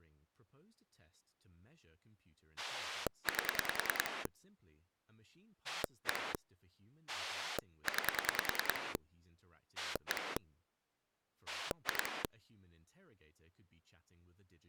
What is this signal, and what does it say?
Pulse dialling, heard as a rotary dial, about 10 pulses a second, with speech in English. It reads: 8 1 9 1 2